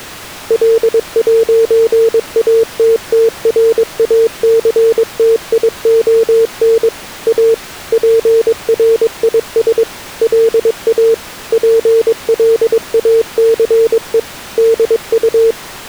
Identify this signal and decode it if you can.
Morse code, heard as a keyed tone, machine-sent, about 22 wpm, 450 Hz. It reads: L'ATTRACTION A PRIS LA PLACE DU